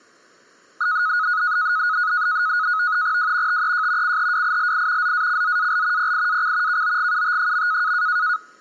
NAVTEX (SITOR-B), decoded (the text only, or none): W TEJ CHWILI ZACZAL PIAC KOGUT.